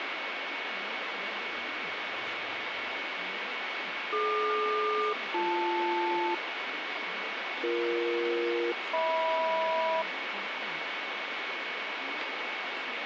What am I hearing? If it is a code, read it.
Aircraft SELCAL, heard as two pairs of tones, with radio static and speech in Tamil. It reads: DQ-BL BE-HM